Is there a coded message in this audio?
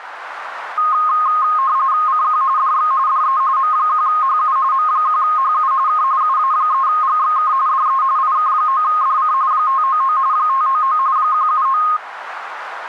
Yes: RTTY (45.45 baud, 170 Hz shift) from 0.8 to 12.0 s, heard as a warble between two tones, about 1160 Hz centre, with radio static. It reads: CQ DX DE M1HU M1HU K UA3GXK DE IK9DC 599 599 179